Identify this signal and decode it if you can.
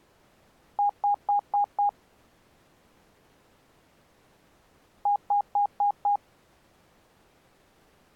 Beep code, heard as beeps, played twice, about 820 Hz. 5 short. In AMI BIOS tables: processor failure; in Dell tables: CMOS battery failure.